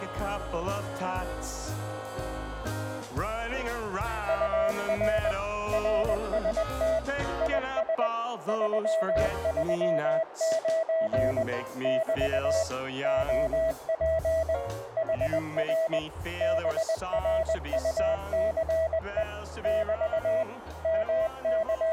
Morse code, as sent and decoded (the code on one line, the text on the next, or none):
..- .-. / .-. ... - / .. ... / ...-- ...-- ----. / -...- / --- .--. / .... .-. / -... .-. ..- -.-. . / -...- / …
UR RST IS 339 <BT> OP HR BRUCE <BT> …